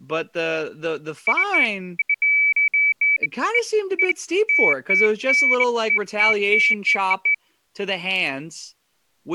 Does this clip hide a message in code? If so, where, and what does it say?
No, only beeps of irregular length, with speech in English.